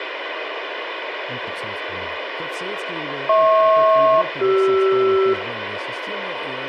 Aircraft SELCAL, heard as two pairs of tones, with radio hiss, room echo and speech in Russian. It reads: HP-CR